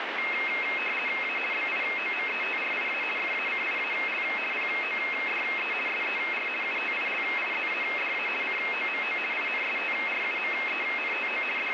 RTTY (50 baud, 450 Hz shift), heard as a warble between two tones, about 2350 Hz centre, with radio static. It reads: A BIOMETRIA FACIAL PODE SER UTILIZADA COMO INSTRUMENTO …